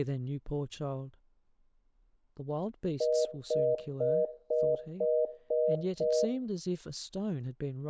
Telephone call progress tone (North American plan), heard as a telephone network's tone, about 480, 620 Hz, 0.25 s on and 0.25 s off, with room echo and speech in English. Congestion tone.